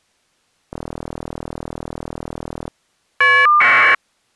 Caller ID data burst, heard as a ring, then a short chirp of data, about 1200 baud.